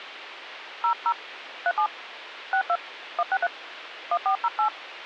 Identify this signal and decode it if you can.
DTMF, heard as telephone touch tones, dialled by hand, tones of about 80 ms, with phone line noise. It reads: 00 37 62 163 1408